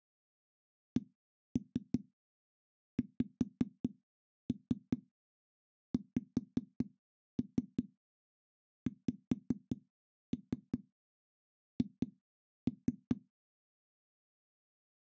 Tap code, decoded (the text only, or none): CXXXH